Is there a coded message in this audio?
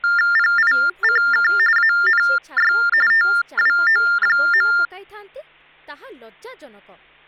Yes: TTY/TDD text telephone tones (45.45 baud Baudot) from 0.0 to 4.9 s, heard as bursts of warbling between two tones, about 400 Hz shift, 1600 Hz centre, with hum and speech in Odia. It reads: PICK ANY TWO.